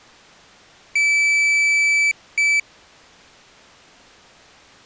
Beep code, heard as a piezo beeper, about 2300 Hz. 1 long, 1 short. In IBM BIOS tables: system board problem.